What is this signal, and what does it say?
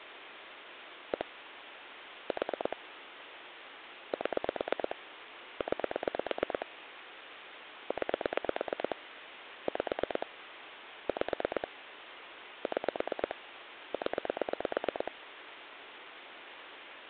Pulse dialling, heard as clicks on a phone line, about 8 pulses a second, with phone line noise. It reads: 1 4 7 9 9 5 5 6 0